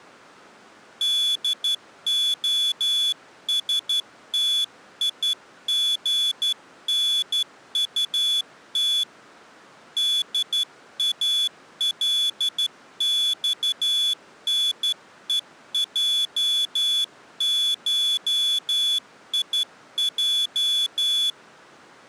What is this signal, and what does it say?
Morse code (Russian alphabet), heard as a high beeper, hand-sent with a straight key, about 12 wpm, 3450 Hz. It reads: ДОСТИГНУТ ДАЛЬНЕЙШИЙ